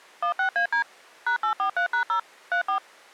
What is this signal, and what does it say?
DTMF, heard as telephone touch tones, dialled by machine, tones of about 100 ms. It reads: 16AD #843#0 34